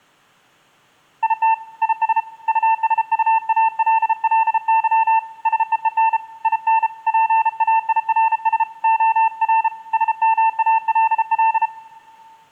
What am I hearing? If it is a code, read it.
Morse code, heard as a keyed tone, hand-sent with a paddle, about 33 wpm, 890 Hz, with room echo. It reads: IT IS USUALLY SEEN IN PAIRS OR SMALL